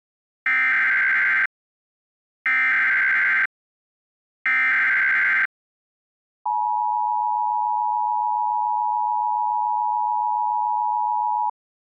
Emergency Alert System (SAME) tones (header bursts, then the 853 and 960 Hz attention tone), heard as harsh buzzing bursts, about 520.83 baud.